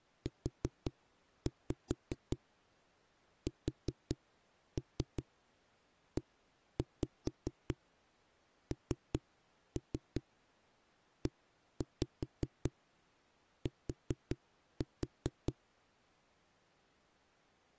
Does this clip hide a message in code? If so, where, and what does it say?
Yes: tap code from 0.3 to 15.5 s, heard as knocks on a wall, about 5 knocks a second. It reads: USENET